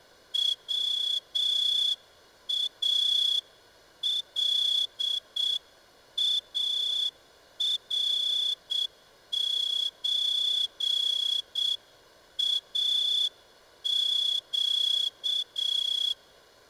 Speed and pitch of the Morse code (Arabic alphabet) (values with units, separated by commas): 7 wpm